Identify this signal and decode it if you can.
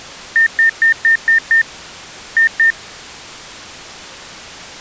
Beep code, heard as beeps, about 1800 Hz. 6-2.